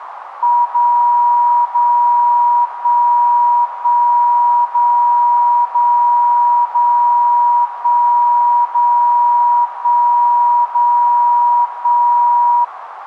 Radio time signal (DCF77), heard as a tone whose level steps once a second, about 960 Hz, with radio static and a narrow filter. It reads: 0 0 1 1 0 0 0 1 0 1 0 1